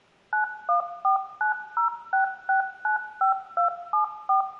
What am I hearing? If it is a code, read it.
DTMF, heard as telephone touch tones, dialled by machine, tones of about 120 ms, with room echo. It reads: 914906695274